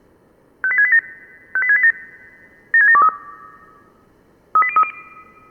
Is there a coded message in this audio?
Yes: five-tone selective call (ZVEI) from 0.6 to 4.9 s, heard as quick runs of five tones, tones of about 70 ms. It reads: 58687 58687 76723 38030